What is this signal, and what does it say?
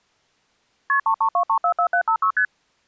Multi-frequency trunk signalling (R1, as on North American trunks), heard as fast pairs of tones, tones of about 80 ms. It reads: KP 332344756 ST